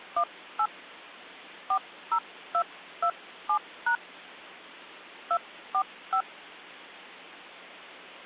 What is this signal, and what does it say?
DTMF, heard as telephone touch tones, dialled by hand, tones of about 80 ms. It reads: 18 40227# 245